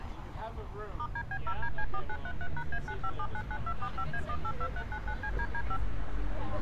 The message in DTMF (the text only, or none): *DB0DC4933#A95799245A182399CDD5